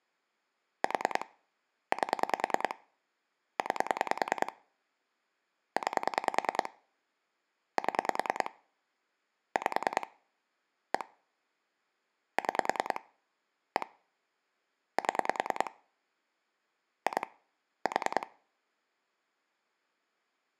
Pulse dialling, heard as clicks on a phone line, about 10 pulses a second. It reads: 4 8 9 9 7 5 1 6 1 7 2 4